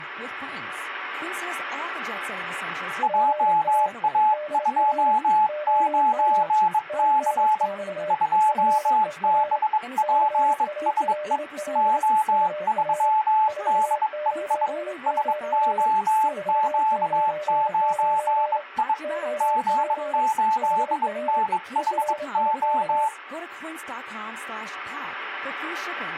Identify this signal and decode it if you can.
Morse code, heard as two keyed tones, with speech in Dutch. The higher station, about 22 wpm, 870 Hz: JA29C 2BPSE O3DEI SOQ9I G8NHO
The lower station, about 27 wpm, 600 Hz: GA DR OM TNX FER CALL UR 499 499 OP HR ERIK